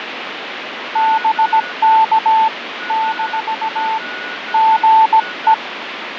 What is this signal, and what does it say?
Morse code, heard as a keyed tone, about 17 wpm, 880 Hz, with radio static, fading and a weaker station near 1460 Hz. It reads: BK - GE